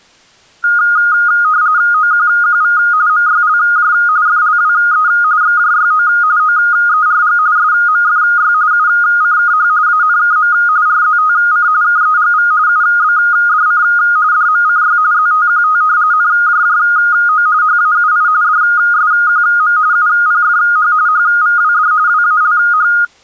RTTY (45.45 baud, 170 Hz shift), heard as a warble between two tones, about 1340 Hz centre. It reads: OQQV MYLJ FLWE XJYO OERG SMFY UCKH ANKM RZTC KEGV UBDC DMCY ZTQT NJJO HAUI DSQM UPFH HVWD WALH